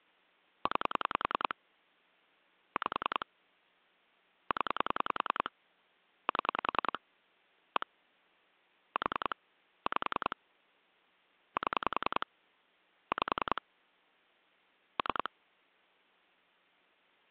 Pulse dialling, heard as clicks on a phone line, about 10 pulses a second. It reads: 9 5 0 7 1 4 5 7 5 3